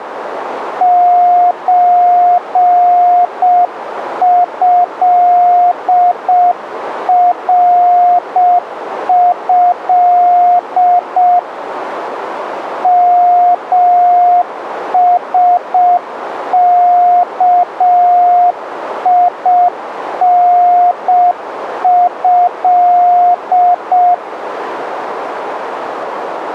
Morse code (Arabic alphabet), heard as a keyed tone, hand-sent with a paddle, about 6 wpm, 710 Hz, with radio static. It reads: زهره مسكينه